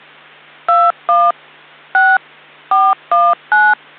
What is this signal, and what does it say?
DTMF, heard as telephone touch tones, dialled by machine, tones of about 220 ms, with hum. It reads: 21 6 419